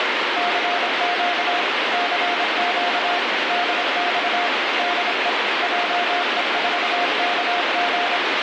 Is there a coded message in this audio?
Yes: Morse code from 0.3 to 8.2 s, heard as a keyed tone, machine-sent, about 26 wpm, 710 Hz, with heavy radio static. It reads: CQ CQ DX DE JE4KG